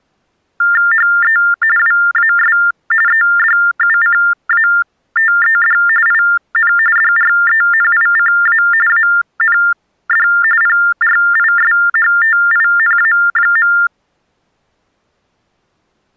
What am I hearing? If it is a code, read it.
TTY/TDD text telephone tones (45.45 baud Baudot), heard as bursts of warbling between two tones, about 400 Hz shift, 1600 Hz centre. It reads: HE WAS EDUCATED IN DRENICA AND PRISHTINA.